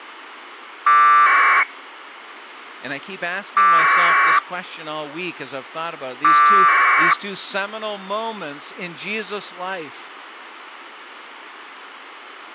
Packet radio (AX.25, as in APRS), 1200 baud, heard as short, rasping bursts, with speech in English.